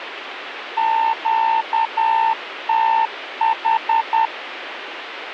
Morse code, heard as a keyed tone, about 10 wpm, 900 Hz, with radio static. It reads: QTH